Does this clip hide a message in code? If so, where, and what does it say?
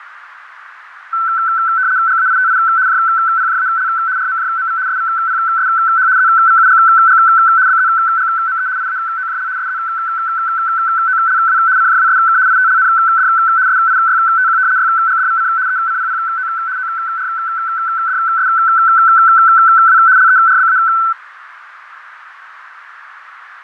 Yes: RTTY (75 baud, 170 Hz shift) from 1.1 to 21.1 s, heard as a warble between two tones, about 1420 Hz centre, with radio static, fading and a narrow filter. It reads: GAITI JPJAL RMJMV SVPSH ZVUGG BZGME IAOJL SZOLW CJWSK ITLND SIYTQ YGDVC ECPPO ORDSW LERBA